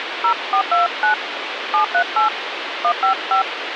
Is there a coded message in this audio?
Yes: DTMF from 0.2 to 3.4 s, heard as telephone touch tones, dialled by hand, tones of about 110 ms, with phone line noise. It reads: 0429 738 155